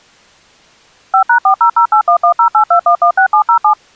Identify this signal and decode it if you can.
DTMF, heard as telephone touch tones, dialled by machine, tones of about 90 ms. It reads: 5#400811082116707